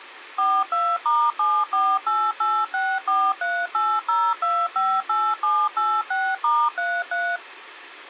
DTMF, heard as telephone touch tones, dialled by machine, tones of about 250 ms. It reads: 42*748864380258786*33